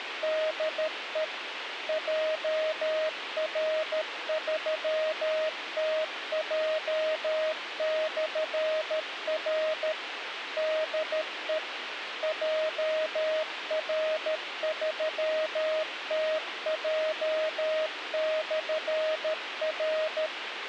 Morse code, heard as a keyed tone, machine-sent, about 13 wpm, 630 Hz, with radio hiss. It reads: DE JR3TJ/R DE JR3TJ/R